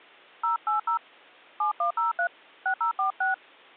DTMF, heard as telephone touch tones, dialled by hand, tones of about 120 ms. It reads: 080 7103 6046